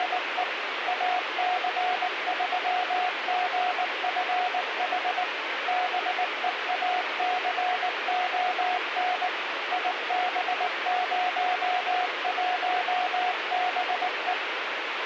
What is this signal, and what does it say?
Morse code, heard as a keyed tone, machine-sent, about 19 wpm, 730 Hz, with radio hiss and a squelch burst at the end. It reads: … AC3GFH BEACON IB01BE